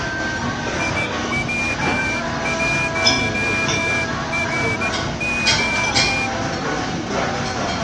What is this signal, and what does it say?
Morse code, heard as a whistle, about 14 wpm, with the noise of a crowd indoors. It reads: IW1RO